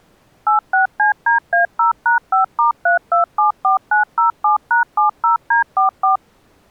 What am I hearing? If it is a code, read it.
DTMF, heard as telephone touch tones, dialled by machine, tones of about 120 ms. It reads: 86CDA0#5*3274907#70D44